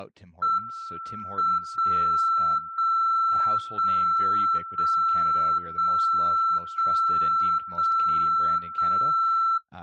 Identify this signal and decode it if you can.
Radio time signal (WWVB), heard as a tone whose level steps once a second, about 1340 Hz, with speech in English. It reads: M 0 0 0 0 0 0 0 0